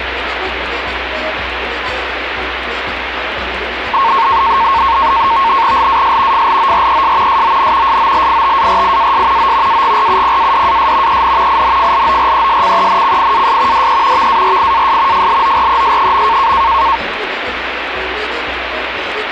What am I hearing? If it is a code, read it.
NAVTEX (SITOR-B), 100 baud, 170 Hz shift, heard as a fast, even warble, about 1000 Hz centre, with radio static. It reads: LAS FLORES SON SOLITARIAS O AGRUPADAS EN INFLORESCENCIAS DE VARIAS FLORES.